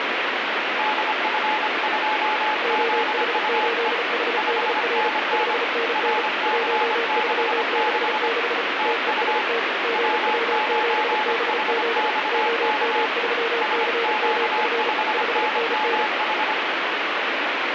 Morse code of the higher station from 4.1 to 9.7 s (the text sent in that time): 5NN RC66 TU